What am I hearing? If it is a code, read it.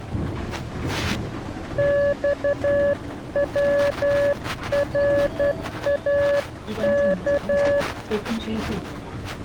Morse code (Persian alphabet), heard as a keyed tone, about 11 wpm, 570 Hz, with the noise inside a bus. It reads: خوراک